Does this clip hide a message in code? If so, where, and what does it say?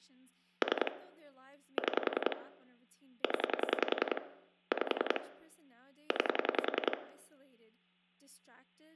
Yes: pulse dialling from 0.6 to 6.9 s, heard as clicks on a phone line, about 10 pulses a second, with hum and speech in English. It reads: 3 6 0 5 9